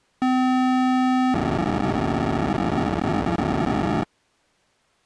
POCSAG pager data (512 baud), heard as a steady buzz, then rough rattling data.